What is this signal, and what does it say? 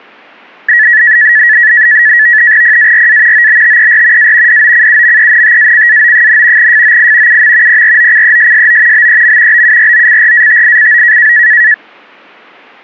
NAVTEX (SITOR-B), 100 baud, 170 Hz shift, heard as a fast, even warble, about 1800 Hz centre. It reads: PARA OBTER A DOCUMENTACAO, FOI UM PROCESSO BEM BUROCRATICO